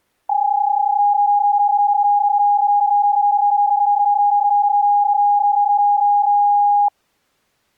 PSK31 (31.25 baud), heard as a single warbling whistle, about 820 Hz.